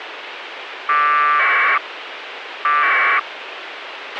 Packet radio (AX.25, as in APRS), 1200 baud, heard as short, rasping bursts, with radio hiss and a squelch burst at the end.